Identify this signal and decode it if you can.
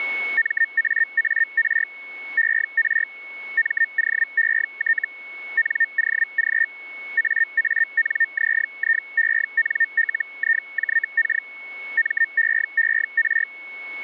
Hellschreiber (Feld-Hell, 122.5 baud), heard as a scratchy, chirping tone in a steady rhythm, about 1800 Hz, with a steady whistle near 2200 Hz. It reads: MAAR ER MOET NOG AANZIENLIJK MEER